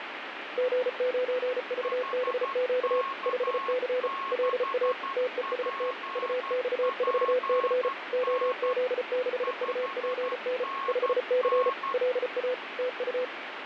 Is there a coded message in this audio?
Yes: Morse code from 0.5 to 13.3 s, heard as two keyed tones, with radio static. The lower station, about 34 wpm, 500 Hz: G9VBQ 5C LA TEST UX4C OZ6UPN 5C LA TU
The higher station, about 12 wpm, 1090 Hz: HK6PPN 5NN